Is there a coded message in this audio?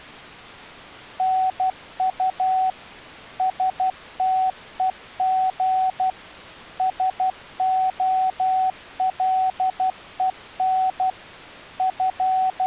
Yes: Morse code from 1.1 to 12.7 s, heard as a keyed tone, machine-sent, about 12 wpm, 750 Hz. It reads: NU STEG SOLEN …